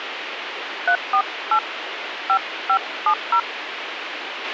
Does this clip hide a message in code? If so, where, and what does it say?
Yes: DTMF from 0.9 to 3.4 s, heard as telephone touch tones, dialled by hand, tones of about 80 ms, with radio hiss and a squelch burst at the end. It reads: 348 5570